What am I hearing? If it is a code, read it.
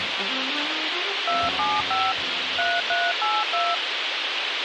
DTMF, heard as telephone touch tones, dialled by machine, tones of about 220 ms, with radio hiss. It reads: 275 3382